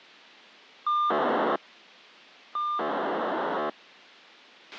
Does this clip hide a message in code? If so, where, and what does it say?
Yes: POCSAG pager data (2400 baud) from 0.9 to 3.7 s, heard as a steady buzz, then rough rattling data, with a squelch burst at the end.